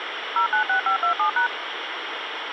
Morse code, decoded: none

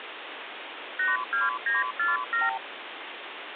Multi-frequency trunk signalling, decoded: 82947

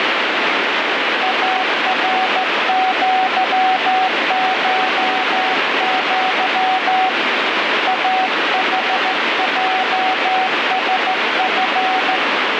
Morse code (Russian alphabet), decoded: АРЪШЪ АХЙСФ

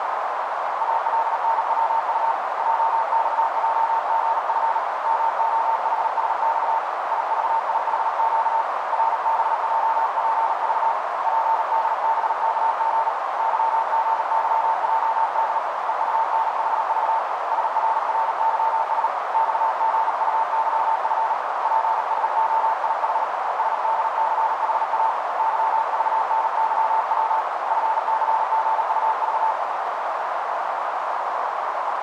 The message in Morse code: ALNWU JXJGF MOHSX IVIHQ RBJPV PDBKG YGYJD EUNHV SRRYS XGUYF PSOIH SDCHA YVNYW FCGUV

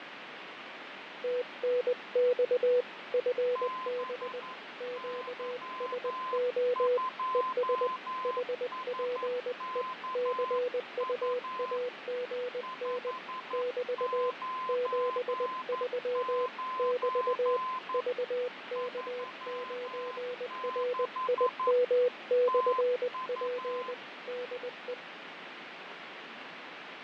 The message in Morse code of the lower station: TNX FB QSO ES HPE CUAGN <BT> 73 <BT> VK9RIM/P DE

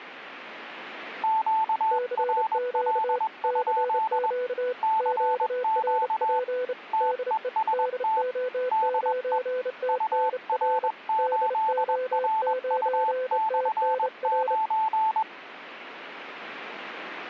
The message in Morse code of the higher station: QRL? CQ TEST DE UR8RU/9

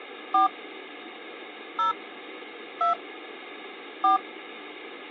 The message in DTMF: 4 0 2 4

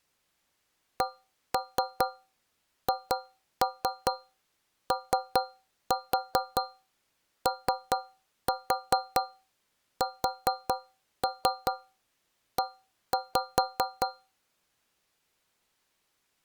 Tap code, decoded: CHOOSE

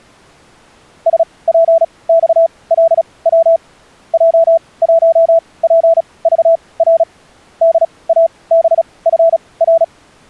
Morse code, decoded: SPXLW J1PVR DABFR

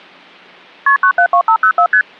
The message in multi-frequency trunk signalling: KP 972504 ST

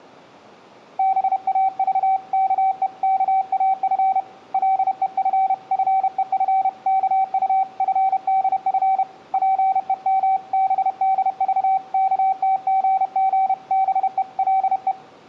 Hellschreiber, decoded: none

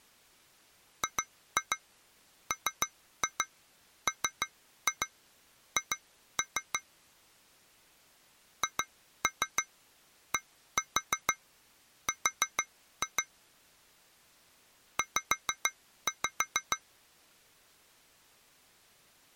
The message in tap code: GMMH HDR Z

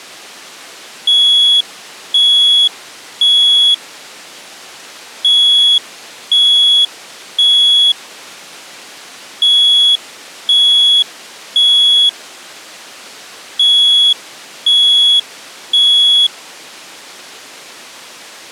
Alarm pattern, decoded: temporal three

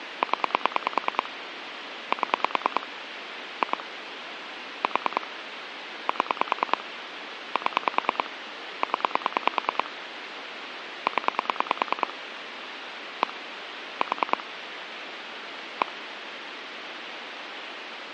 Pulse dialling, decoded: 0 7 2 4 7 7 0 0 1 4 1

